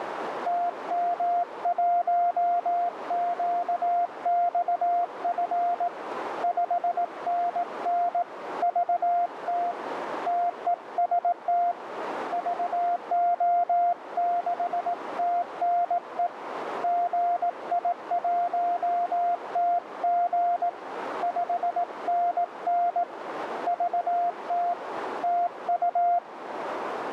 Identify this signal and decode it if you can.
Morse code, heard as a keyed tone, hand-sent with a paddle, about 18 wpm, 700 Hz, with radio static and a narrow filter. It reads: TM1QXF 5NN VT TEST VO6TNE GI1TG 5NN VT TU